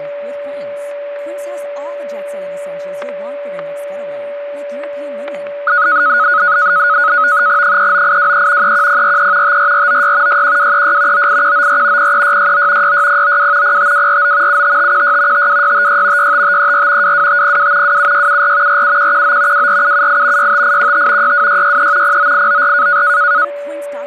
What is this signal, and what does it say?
NAVTEX (SITOR-B), 100 baud, 170 Hz shift, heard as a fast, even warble, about 1360 Hz centre, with static crashes, a steady whistle near 580 Hz and speech in English. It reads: 39823 31043 54496 61236 98194 03669 66092 05249 75516 52656 65534 22502 27674 47119 24778 65815 62663 09894